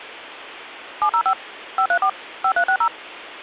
DTMF, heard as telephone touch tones, dialled by machine, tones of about 80 ms. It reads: 705 534 5360